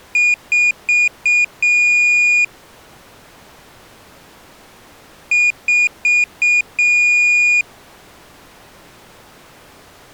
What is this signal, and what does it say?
Beep code, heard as a piezo beeper, played twice, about 2450 Hz. 4 short, 1 long.